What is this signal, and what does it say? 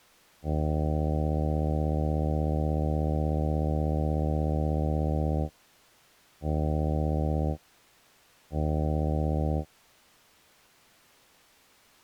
Ship horn signal, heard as a ship's horn, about 80 Hz. 1 long, 2 short. At sea: a vessel in fog that is sailing, fishing, towing or hampered.